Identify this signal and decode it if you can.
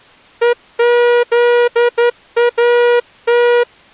Morse code (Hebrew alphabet), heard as a horn, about 11 wpm. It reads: וזאת